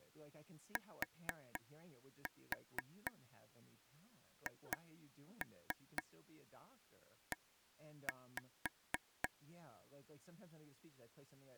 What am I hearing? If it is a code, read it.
Tap code, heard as taps on a table, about 4 knocks a second, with speech in English. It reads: THE